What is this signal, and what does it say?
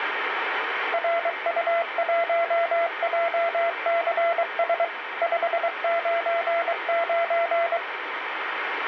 Morse code, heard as a keyed tone, machine-sent, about 23 wpm, 680 Hz, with radio static. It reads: RU1JCS 599